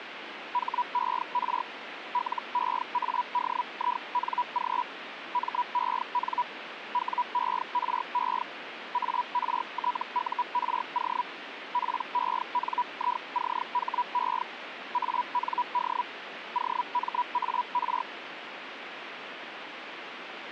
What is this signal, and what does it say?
Hellschreiber (Feld-Hell, 122.5 baud), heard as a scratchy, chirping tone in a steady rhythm, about 980 Hz, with radio static. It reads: HER LEADING MEN WERE ARTURO PENICHE AND OMAR